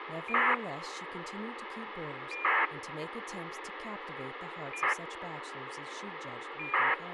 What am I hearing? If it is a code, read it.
ACARS aircraft data, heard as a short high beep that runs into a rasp, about 2400 baud, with radio hiss and speech in English.